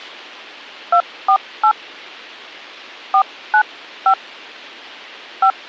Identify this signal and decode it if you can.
DTMF, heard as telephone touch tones, dialled by hand, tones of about 80 ms. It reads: 248 495 5